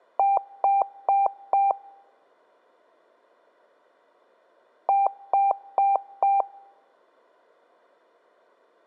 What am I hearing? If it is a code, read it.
Beep code, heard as beeps, played twice, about 790 Hz, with room echo. 4 short. In AMI BIOS tables: system timer failure; in Dell tables: memory read or write failure.